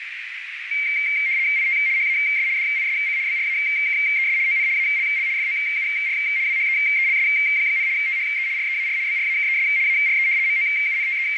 RTTY (75 baud, 170 Hz shift), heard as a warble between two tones, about 2200 Hz centre, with radio static and a narrow filter. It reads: IT HAS DISC BRAKES ON ALL FOUR WHEELS, THE REAR BRAKES ARE …